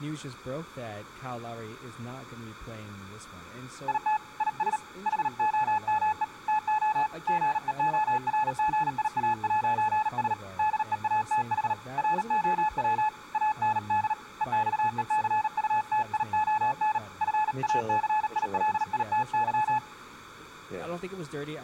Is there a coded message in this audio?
Yes: Morse code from 3.8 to 19.8 s, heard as a keyed tone, hand-sent with a paddle, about 38 wpm, 860 Hz, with speech in English. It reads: IT IS HOME TO GEORGIA'S DEATH ROW AND EXECUTION FACILITY